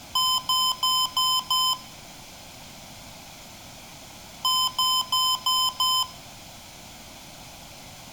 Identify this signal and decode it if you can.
Beep code, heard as beeps from a small speaker, played twice, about 1020 Hz, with room echo. 5 short. In AMI BIOS tables: processor failure; in Dell tables: CMOS battery failure.